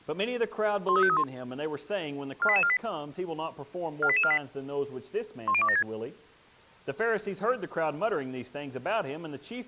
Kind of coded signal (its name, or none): five-tone selective call